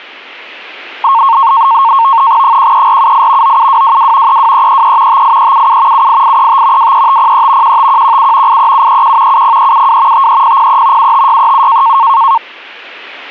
NAVTEX (SITOR-B), 100 baud, 170 Hz shift, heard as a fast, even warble, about 1000 Hz centre. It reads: 13478 97222 32333 58377 78835 23503 15117 83731 70372 53003 75637